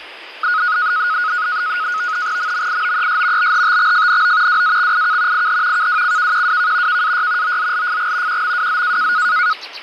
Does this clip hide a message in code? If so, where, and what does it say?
Yes: NAVTEX (SITOR-B), 100 baud, 170 Hz shift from 0.4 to 9.5 s, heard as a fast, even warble, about 1360 Hz centre, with fading and the noise of a park. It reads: MMIOES BHTXFNO WAXIK IH KWCKQWK KAY OZLFG QMWZ